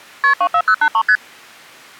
Multi-frequency trunk signalling (R1, as on North American trunks), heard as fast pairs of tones, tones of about 70 ms. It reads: KP 24083 ST